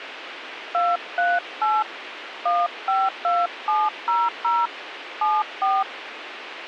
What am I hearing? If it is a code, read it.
DTMF, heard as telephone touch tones, dialled by hand, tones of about 210 ms, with radio hiss. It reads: 238 152700 74